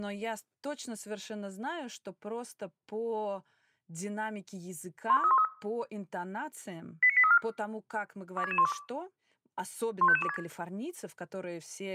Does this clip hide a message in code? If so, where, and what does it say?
Yes: five-tone selective call (ZVEI) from 5.1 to 10.4 s, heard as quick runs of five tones, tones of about 70 ms, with speech in Russian. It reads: 12313 89834 26612 15526